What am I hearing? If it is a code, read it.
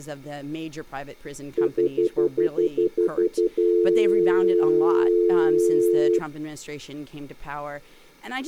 Telephone call progress tone (North American plan), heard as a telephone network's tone, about 350, 440 Hz, 0.1 s on and 0.1 s off, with room echo and speech in English. Stutter dial tone.